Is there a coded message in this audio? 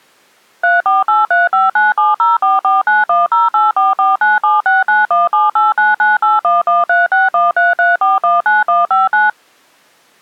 Yes: DTMF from 0.6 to 9.3 s, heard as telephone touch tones, dialled by machine, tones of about 170 ms. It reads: 348359704491084497691789981136133419159